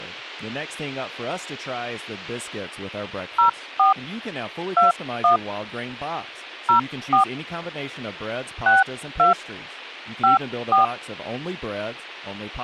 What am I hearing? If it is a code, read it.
DTMF, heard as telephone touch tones, dialled by hand, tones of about 130 ms, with speech in English. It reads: 04 21 04 62 54